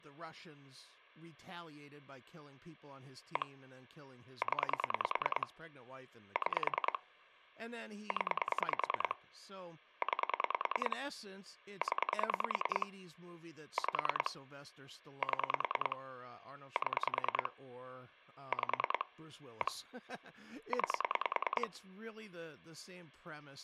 Pulse dialling, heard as clicks on a phone line, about 10 pulses a second, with speech in English. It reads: 1 0 6 0 9 0 5 7 7 5 1 9